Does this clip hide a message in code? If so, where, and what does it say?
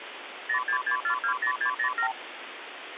Yes: multi-frequency trunk signalling (R2, with the far end's replies) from 0.5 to 2.1 s, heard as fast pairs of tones, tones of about 90 ms, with phone line noise. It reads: 066420607